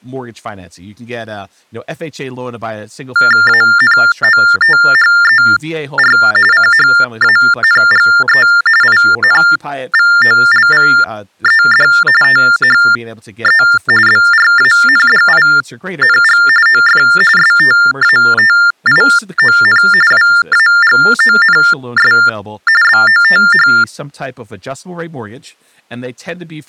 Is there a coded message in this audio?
Yes: TTY/TDD text telephone tones (45.45 baud Baudot) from 3.2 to 23.8 s, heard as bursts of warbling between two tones, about 400 Hz shift, 1600 Hz centre, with speech in English. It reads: ANOTHER CHANGE INVOLVED THE BRANDING OF STATION WAGONS BOTH